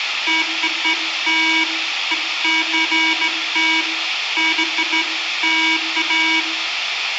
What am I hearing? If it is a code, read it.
Beeps of irregular length, with radio hiss and room echo. There is no code.